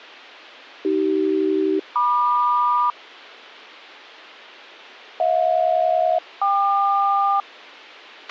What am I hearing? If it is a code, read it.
Aircraft SELCAL, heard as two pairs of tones, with a squelch burst at the end. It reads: AC-MQ HJ-KQ